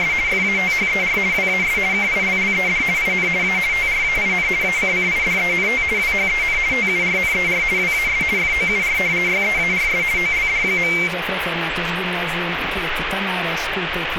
RTTY (50 baud, 170 Hz shift), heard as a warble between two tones, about 2200 Hz centre, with radio static. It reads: … FATHER WAS KILLED IN A TRAIN ACCIDENT WHEN TURNER WAS FOUR YEARS OLD.